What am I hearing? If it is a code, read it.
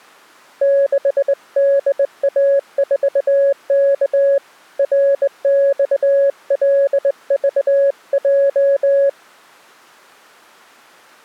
Morse code, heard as a keyed tone, hand-sent with a straight key, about 20 wpm, 560 Hz. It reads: 6DA4K RXLVJ